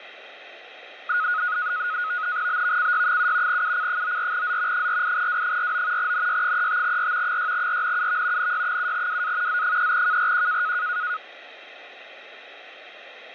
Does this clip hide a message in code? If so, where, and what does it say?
Yes: NAVTEX (SITOR-B), 100 baud, 170 Hz shift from 1.1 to 11.2 s, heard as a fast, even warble, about 1360 Hz centre. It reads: BVCY7 UC94Z 48W49 NY35R 6RNUV NY7WA Z3KRQ